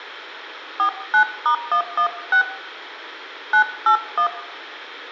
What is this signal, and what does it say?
DTMF, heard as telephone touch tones, dialled by hand, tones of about 90 ms, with room echo. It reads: 49*116 981